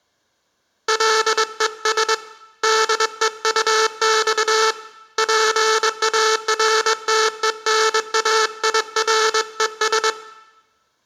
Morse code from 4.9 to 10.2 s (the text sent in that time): PARTENAIRES